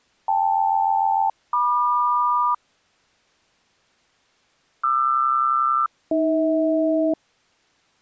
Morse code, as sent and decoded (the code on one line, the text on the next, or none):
none